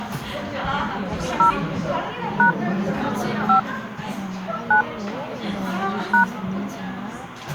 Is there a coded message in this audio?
Yes: DTMF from 1.4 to 6.2 s, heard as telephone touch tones, dialled by hand, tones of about 110 ms, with the noise of a crowd indoors. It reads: 0 # 5 9 #